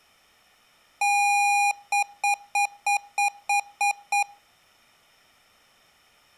Beep code, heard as beeps from a small speaker, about 810 Hz. 1 long, 8 short. In AMI BIOS tables: display or retrace test failure.